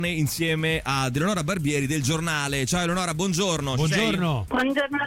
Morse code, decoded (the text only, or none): none